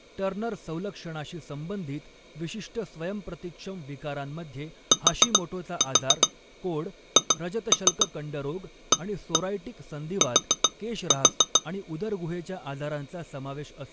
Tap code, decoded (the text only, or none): THAT